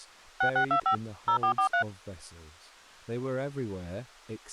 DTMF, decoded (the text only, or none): 6625 0443